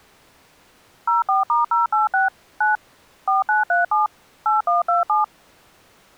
DTMF, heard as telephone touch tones, dialled by machine, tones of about 150 ms. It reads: 04*086 9 4937 8127